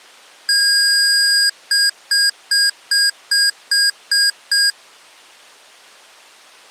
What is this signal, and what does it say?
Beep code, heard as beeps from a small speaker, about 1650 Hz. 1 long, 8 short. In AMI BIOS tables: display or retrace test failure.